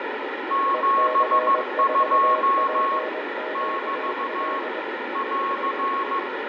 Morse code, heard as two keyed tones, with radio static, fading and room echo. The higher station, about 15 wpm, 1100 Hz: 72 <BT> <AR>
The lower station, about 21 wpm, 620 Hz: EC4PQL